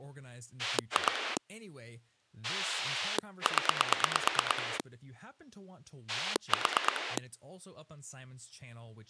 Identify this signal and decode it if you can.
Pulse dialling, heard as a rotary dial, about 9 pulses a second, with speech in English. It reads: 2 0 4